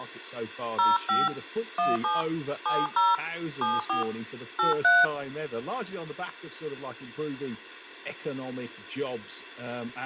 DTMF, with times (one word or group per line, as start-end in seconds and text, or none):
0.8-1.3 05
1.8-2.2 17
2.7-3.1 70
3.6-4.0 74
4.6-5.0 83